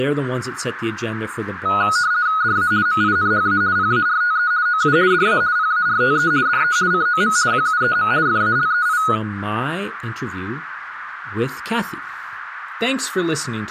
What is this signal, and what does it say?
RTTY (50 baud, 170 Hz shift), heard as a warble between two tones, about 1360 Hz centre, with radio static and speech in English. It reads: DA MINHA PARTE OU DA PARTE DE COM QUEM FALEI